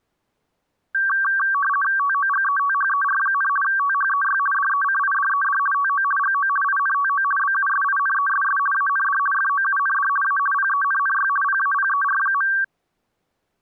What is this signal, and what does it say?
RTTY (50 baud, 450 Hz shift), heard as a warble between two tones, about 1350 Hz centre. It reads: TOGETHER, THEY DECIDED TO GO INTO BUSINESS AND FOUND A PENNY PAPER.